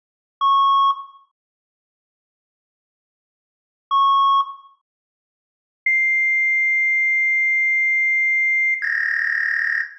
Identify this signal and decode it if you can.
Fax machine handshake, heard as beeps, a long tone and a warble, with room echo.